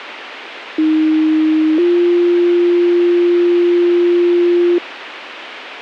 Two-tone page, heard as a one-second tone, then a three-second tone, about 310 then 350 Hz, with radio hiss.